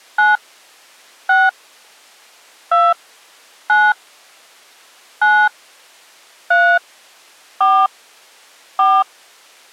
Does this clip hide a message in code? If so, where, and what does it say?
Yes: DTMF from 0.2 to 9.0 s, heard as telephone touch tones, dialled by hand, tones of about 230 ms. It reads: 9 6 2 9 9 3 4 4